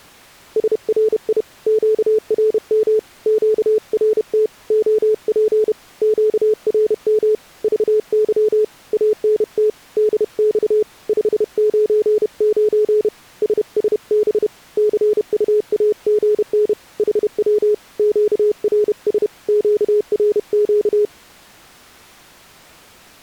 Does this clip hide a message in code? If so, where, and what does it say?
Yes: Morse code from 0.5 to 21.1 s, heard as a keyed tone, hand-sent with a paddle, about 31 wpm, 430 Hz. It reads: SRI QRM QRT OP QRM VY ANT DX 599 SSB CUAGN HW QRS QRQ